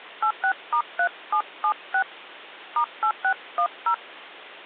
DTMF, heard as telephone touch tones, dialled by hand, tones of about 80 ms. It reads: 86*3776 *8610